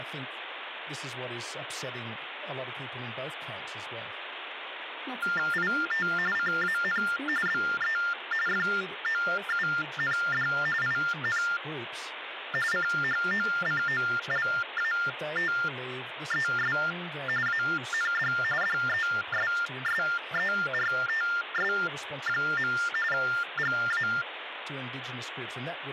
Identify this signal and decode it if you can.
TTY/TDD text telephone tones (45.45 baud Baudot), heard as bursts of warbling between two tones, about 400 Hz shift, 1600 Hz centre, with phone line noise and speech in English. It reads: IT CAN BE FOUND IN CHOCOLATES AND DESSERTS. GA